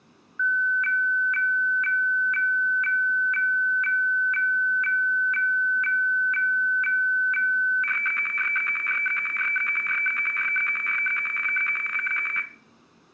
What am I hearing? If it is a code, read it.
Weather fax (radiofax), 120 lines a minute, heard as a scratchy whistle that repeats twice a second, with room echo.